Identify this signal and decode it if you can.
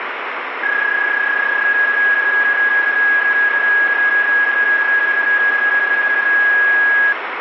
PSK31 (31.25 baud), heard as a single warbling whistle, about 1650 Hz, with radio static.